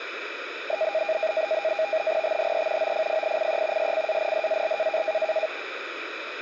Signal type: NAVTEX (SITOR-B)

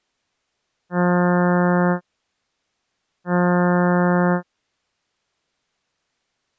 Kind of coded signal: ship horn signal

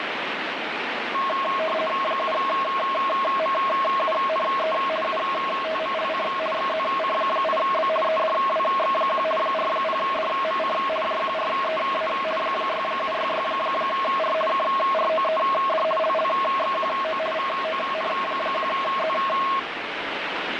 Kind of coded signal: RTTY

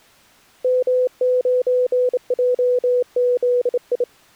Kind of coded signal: Morse code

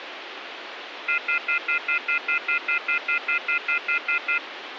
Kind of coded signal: telephone call progress tone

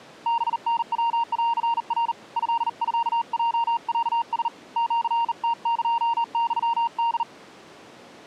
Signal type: Morse code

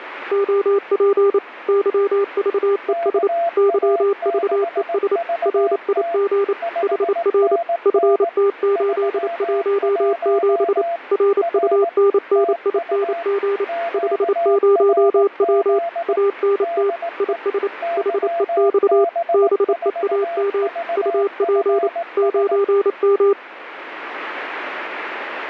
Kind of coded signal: Morse code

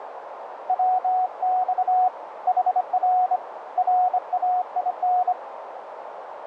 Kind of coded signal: Morse code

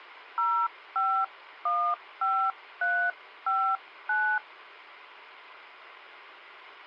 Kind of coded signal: DTMF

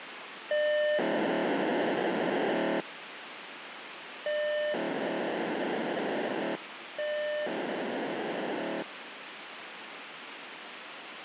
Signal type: POCSAG pager data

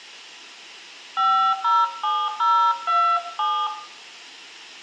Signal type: DTMF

